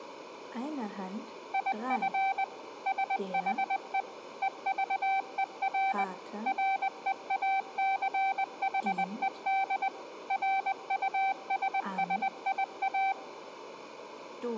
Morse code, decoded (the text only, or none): IF SHE EVER REACHED RUSSIA